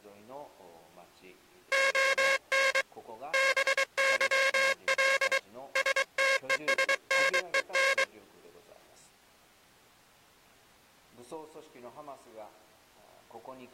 Morse code (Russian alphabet), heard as a buzzer, hand-sent with a paddle, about 23 wpm. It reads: ОН БЫЛ СТЕСНЕН